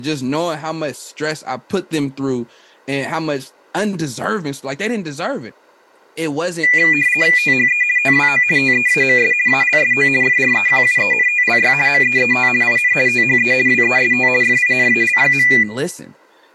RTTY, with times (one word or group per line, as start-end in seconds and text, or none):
7.4-7.8 THE
8.0-8.4 TWO
8.6-9.3 TEAMS
9.5-10.1 ALSO
10.2-11.7 FREQUENTLY
11.9-12.5 MEET
12.6-12.9 IN
13.1-13.5 THE
13.7-14.3 WEST
14.4-15.5 FINAL.